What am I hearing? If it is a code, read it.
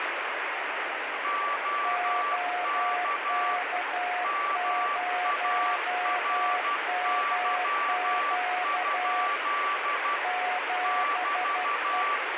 Morse code, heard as two keyed tones, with heavy radio static. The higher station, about 12 wpm, 1160 Hz: OK MARY? <BT>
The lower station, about 12 wpm, 720 Hz: OK0MQ 7E